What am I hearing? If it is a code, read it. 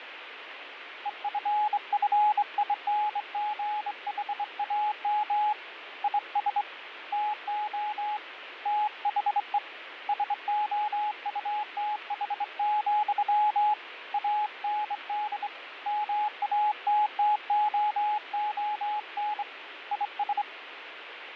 Morse code, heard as a keyed tone, hand-sent with a straight key, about 24 wpm, 840 Hz, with radio static and fading. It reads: EFFINGHAM IS TO THE SOUTH, AND MATTOON IS